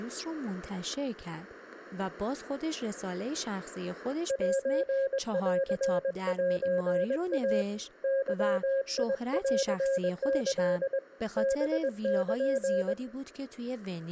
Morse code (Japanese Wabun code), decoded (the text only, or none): センセイ ゲンキ ハル